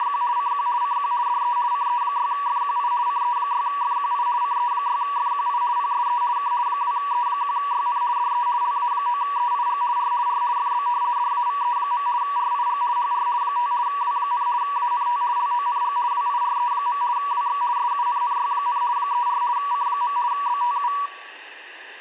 RTTY (50 baud, 170 Hz shift), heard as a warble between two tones, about 1050 Hz centre. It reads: … CQ CQ DE CE6FQI CE6FQI CE6FQI PSE K 2E1YN DE LA9EIG R R FB DAVE. RIG HR 5 W, ANT LONG WIRE. WX SUNNY, 34 C. BTU